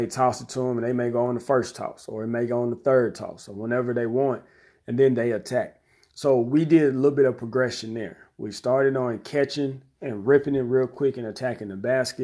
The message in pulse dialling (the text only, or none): none